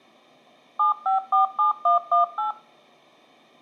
DTMF, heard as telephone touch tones, dialled by machine, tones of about 130 ms. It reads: 7547118